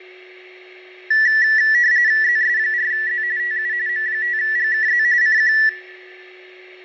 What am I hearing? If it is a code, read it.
RTTY (45.45 baud, 170 Hz shift), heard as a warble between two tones, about 1850 Hz centre, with fading and a steady whistle near 370 Hz. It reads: ZS4Z TU M5GKZ CQ